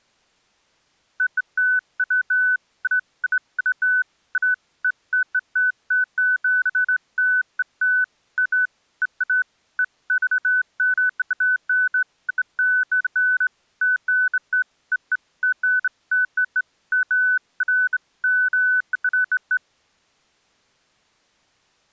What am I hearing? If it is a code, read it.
Beeps of irregular length. There is no code.